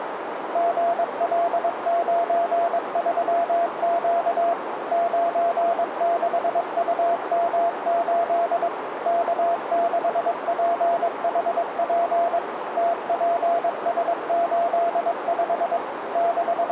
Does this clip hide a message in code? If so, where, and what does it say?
Yes: Morse code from 0.5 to 16.7 s, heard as a keyed tone, machine-sent, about 22 wpm, 680 Hz, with radio static and a narrow filter. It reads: GL93Q 96UM8 K6PHP TPS85 …